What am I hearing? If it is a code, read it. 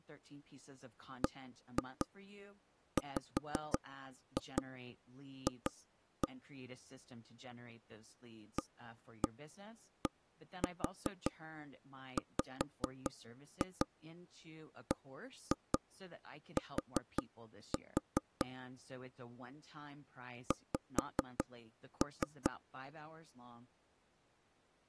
Tap code, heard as taps on a table, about 5 knocks a second, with speech in English. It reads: BWF ADWBT X